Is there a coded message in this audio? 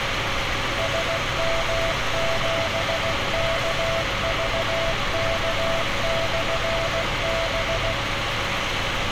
Yes: Morse code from 0.7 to 8.0 s, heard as a keyed tone, machine-sent, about 16 wpm, 660 Hz, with radio hiss and street noise. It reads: SM7KVK/B